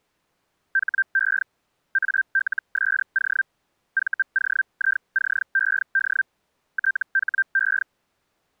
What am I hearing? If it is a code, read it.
Hellschreiber (Feld-Hell, 122.5 baud), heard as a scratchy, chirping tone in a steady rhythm, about 1550 Hz. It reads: HE ALSO VOICED THE